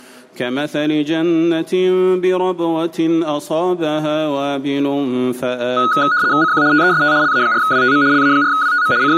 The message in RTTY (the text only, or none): CQ TEST LA4WTM LA4WTM …